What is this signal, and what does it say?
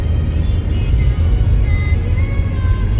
The noise inside a car. There is no code.